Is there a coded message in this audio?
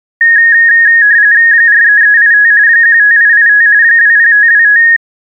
Yes: RTTY (45.45 baud, 170 Hz shift) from 0.2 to 5.0 s, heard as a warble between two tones, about 1750 Hz centre. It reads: 43385 15885 20525